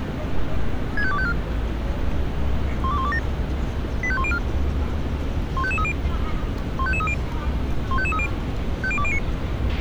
Five-tone selective call (ZVEI), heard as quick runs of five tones, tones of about 70 ms, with a squelch burst at the end and street noise. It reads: 65254 12127 85104 15530 15530 15530 50209